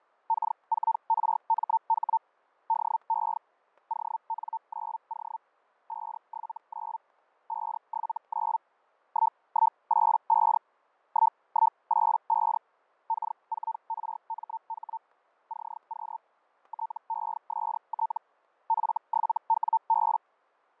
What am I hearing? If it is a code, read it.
Hellschreiber (Feld-Hell, 122.5 baud), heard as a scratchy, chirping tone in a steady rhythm, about 900 Hz, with fading and static crashes. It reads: K4RMH DE ON9O 579 579 1185 1185 K4RMH CQ TEST F7WB